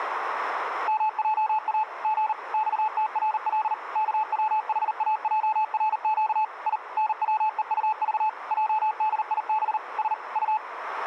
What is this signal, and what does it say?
Morse code, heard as a keyed tone, machine-sent, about 39 wpm, 870 Hz, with radio static and a narrow filter. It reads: MJA G XTRL KWHAJRQ I NWEUV JDIB S U